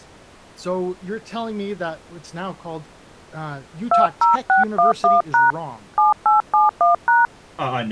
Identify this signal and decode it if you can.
DTMF, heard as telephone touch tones, dialled by hand, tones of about 150 ms, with speech in English. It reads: 20611# 7871#